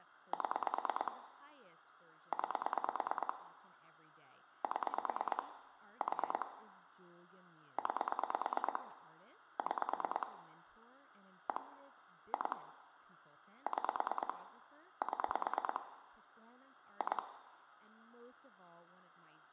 Pulse dialling, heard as clicks on a phone line, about 9 pulses a second, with hum, room echo and speech in English. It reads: 7 9 7 4 9 6 1 2 6 7 2